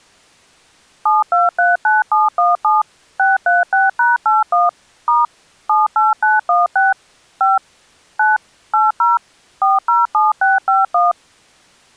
DTMF, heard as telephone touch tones, dialled by machine, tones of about 170 ms. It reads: 7239717 636#81 * 78916 5 9 80 407651